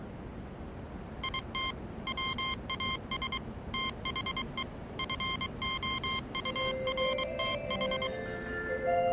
Morse code, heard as electronic beeps, machine-sent, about 23 wpm, 1060 Hz, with the noise of a subway station. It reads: IT WAS THE FOURTH